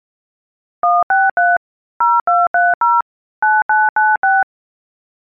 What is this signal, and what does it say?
DTMF, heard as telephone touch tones, dialled by machine, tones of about 200 ms. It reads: 163 0230 9996